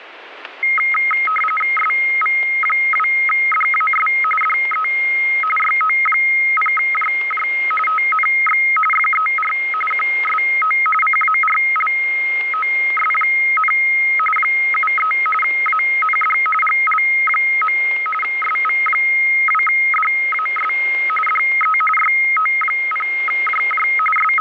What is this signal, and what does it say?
RTTY (45.45 baud, 850 Hz shift), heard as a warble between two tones, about 1700 Hz centre, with radio static and static crashes. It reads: SV2DAS DE YO0JJ TNX FER QSO CARLOS, 73 AND GL. SV2DAS DE YO0JJ …